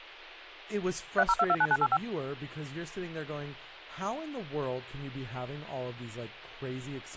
DTMF, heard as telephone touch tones, dialled by machine, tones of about 50 ms, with speech in English. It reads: 30229985